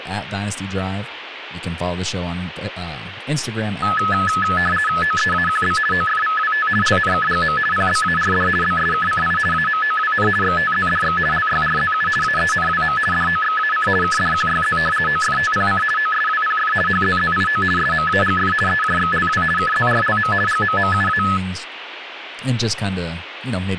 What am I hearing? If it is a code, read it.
RTTY (50 baud, 450 Hz shift), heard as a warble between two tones, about 1500 Hz centre, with radio static and speech in English. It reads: OEAQB OFVWT LNKGM PBARD BSKCI AMOWN XTZDX LYRZU AENWM DOXAC KDQYZ OFTPC OSWPF HZZIO SMAGF EJXLW KZRLM GMMUA